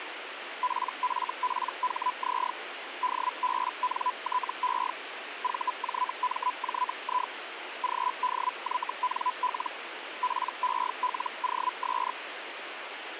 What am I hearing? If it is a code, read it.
Hellschreiber (Feld-Hell, 122.5 baud), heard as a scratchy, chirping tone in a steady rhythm, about 1000 Hz, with radio static. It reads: PFPHZ DBNTE VJMJI GDYNL PELOS